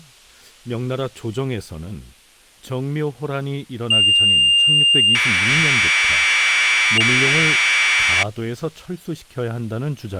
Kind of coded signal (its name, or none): Commodore tape loading